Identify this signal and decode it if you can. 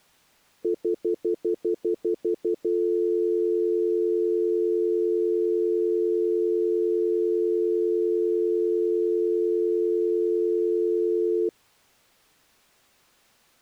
Telephone call progress tone (North American plan), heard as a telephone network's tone, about 350, 440 Hz, 0.1 s on and 0.1 s off. Stutter dial tone.